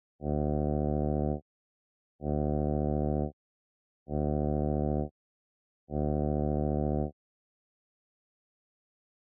Ship horn signal, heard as a ship's horn, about 70 Hz. 4 short. At sea: a pilot vessel's identity signal in fog.